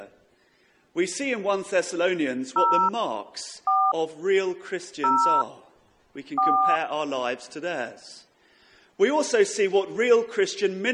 DTMF, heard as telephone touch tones, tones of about 290 ms. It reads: 0 4 0 4